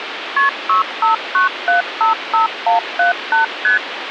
Multi-frequency trunk signalling (R1, as on North American trunks), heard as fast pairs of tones, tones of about 130 ms, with phone line noise. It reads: KP 659755178 ST